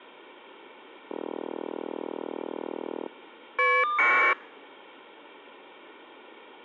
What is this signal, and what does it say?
Caller ID data burst, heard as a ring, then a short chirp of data, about 1200 baud.